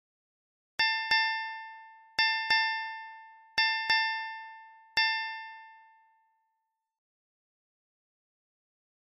Ship's bell, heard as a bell. 7. Seven half-hours of the watch have passed.